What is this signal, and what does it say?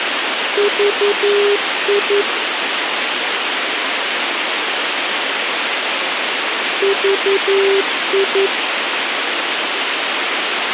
Morse code, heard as a keyed tone, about 11 wpm, 400 Hz, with radio hiss. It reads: VI VI